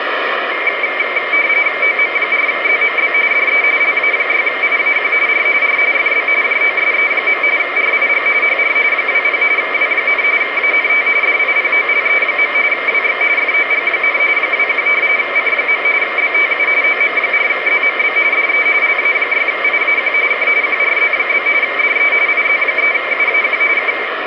RTTY (45.45 baud, 170 Hz shift), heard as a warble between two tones, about 2200 Hz centre, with radio static. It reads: OM4ZMB DE LA6IAQ R R FB JOSE. RIG HR 20 W, ANT DIPOLE. WX FOG, 21 C. BTU OM4ZMB DE LA6IAQ K QRZ? DE IZ3UAQ K